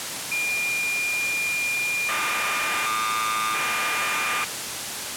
Cassette data (Kansas City type), 1200 baud, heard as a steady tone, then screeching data, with tape hiss.